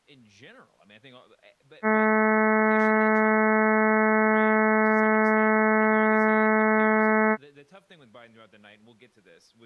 Ship horn signal, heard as a ship's horn, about 220 Hz, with speech in English. 1 long. At sea: a vessel nearing a blind bend, or under power and making way in fog.